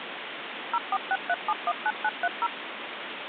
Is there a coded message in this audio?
Yes: DTMF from 0.7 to 2.5 s, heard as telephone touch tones, dialled by machine, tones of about 50 ms, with phone line noise. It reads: 0463719930